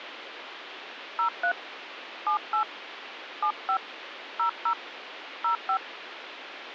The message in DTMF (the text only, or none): 03 78 75 00 05